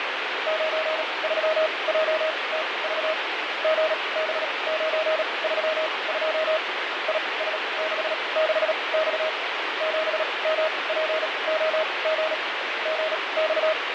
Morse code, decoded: 93JTV GB932 IS66X 7MPOG …

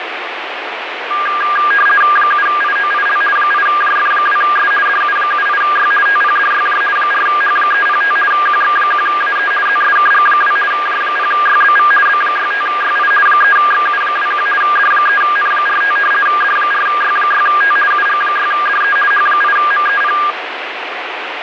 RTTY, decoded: 7IOIL 8JF2S DU78Y TPDYJ 4H305 QX1AE ZSKG2 J0YBV B65YI 3XU21 D3N45 D4Y6T UG6DE H8MEP

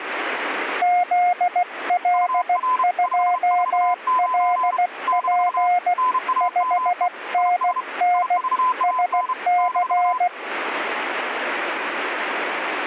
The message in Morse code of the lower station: ZL2LP 5NN SC

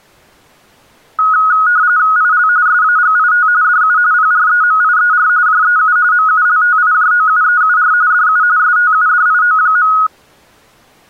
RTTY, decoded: IL SAGIT DU PREMIER JEU MULTIJOUEUR DU STUDIO.

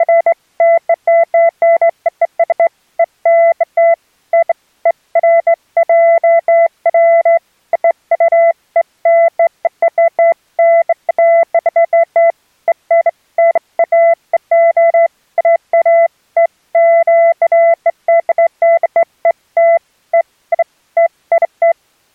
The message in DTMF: none

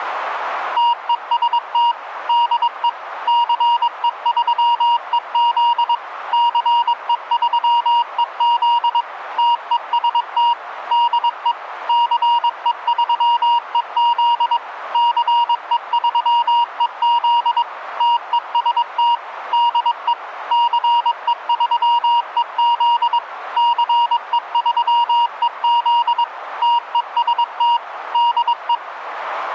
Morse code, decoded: TEST DE CE3EZ CE3EZ TEST DE CE3EZ CE3EZ TEST DE CE3EZ CE3EZ TEST DE

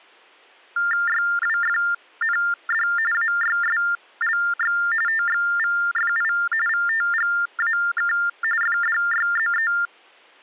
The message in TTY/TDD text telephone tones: YWFND AYSLX TXVFI VTGAK FDYZE

